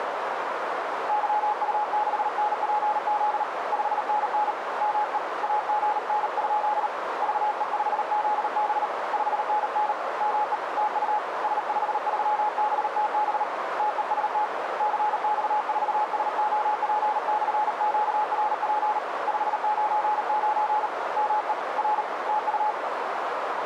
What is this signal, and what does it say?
Morse code, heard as a keyed tone, hand-sent with a paddle, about 38 wpm, 850 Hz, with radio static and a narrow filter. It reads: YU6NPZ 5NN ME AGN? VE5ZB 5NN ME TU S53BTB TEST CX4SOP/QRP 599 ME R TU